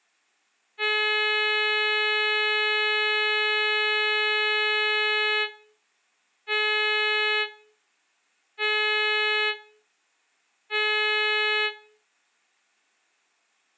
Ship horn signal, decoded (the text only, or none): 1 long, 3 short